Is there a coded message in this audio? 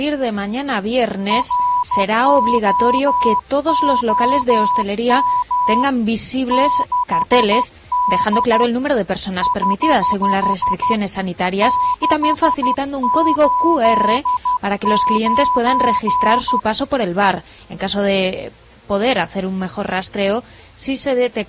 Yes: Morse code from 1.2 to 16.7 s, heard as a keyed tone, hand-sent with a paddle, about 12 wpm, 990 Hz. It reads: ROOM 6D <HH> 689